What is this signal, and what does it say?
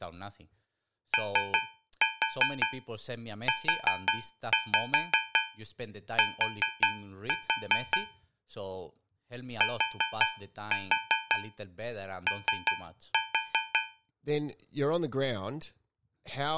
Tap code, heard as taps on a metal pipe, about 5 knocks a second, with speech in English. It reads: OUT TO